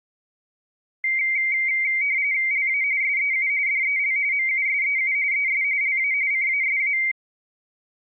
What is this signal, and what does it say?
RTTY (45.45 baud, 170 Hz shift), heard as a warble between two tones, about 2200 Hz centre. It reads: LA SEU DEL MUSEU ES LA CASA